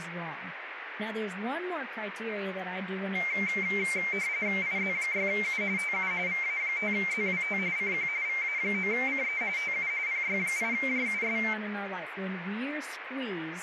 RTTY (45.45 baud, 170 Hz shift), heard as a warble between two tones, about 2200 Hz centre, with radio static and speech in English. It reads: IZ6U TU VA5ZWT CQ VA9CE TU PY8JUS